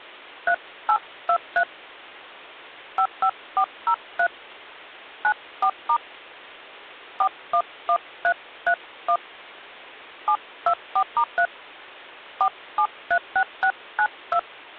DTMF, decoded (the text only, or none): 3823 55403 94* 411331 724*3 4736692